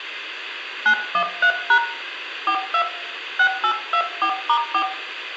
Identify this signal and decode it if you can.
DTMF, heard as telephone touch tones, dialled by hand, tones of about 80 ms, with room echo. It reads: 913# 42 6824*4